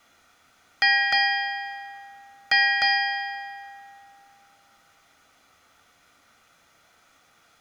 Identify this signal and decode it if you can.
Ship's bell, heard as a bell, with room echo. 4. Four half-hours of the watch have passed.